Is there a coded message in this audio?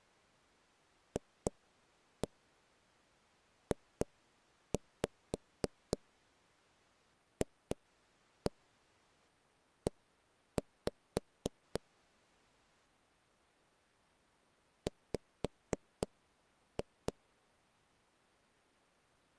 Yes: tap code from 1.2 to 17.1 s, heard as taps on a table, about 3 knocks a second. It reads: FJFE W